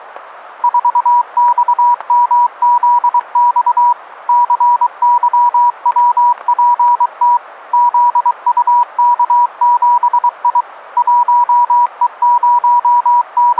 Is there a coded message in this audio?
Yes: Morse code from 0.6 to 13.6 s, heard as a keyed tone, machine-sent, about 23 wpm, 970 Hz, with static crashes. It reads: 4XMZX CYWPT ZUK7I …